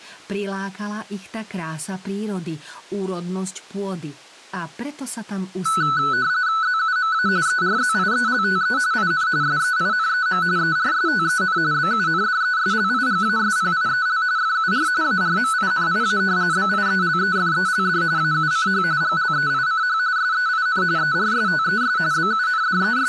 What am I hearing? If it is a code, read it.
RTTY (45.45 baud, 170 Hz shift), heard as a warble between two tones, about 1400 Hz centre, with speech in Slovak. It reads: ZUMA ERZIELTE IN SEINEM ERSTEN BUNDESLIGASPIEL FUR ARMINIA BIELEFELD AUCH GLEICH SEIN ERSTES …